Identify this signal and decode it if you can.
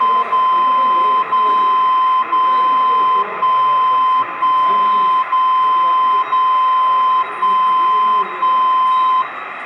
Radio time signal (DCF77), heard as a tone whose level steps once a second, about 1030 Hz, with radio static and the noise of a subway station. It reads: 0 0 0 1 1 0 0 1 1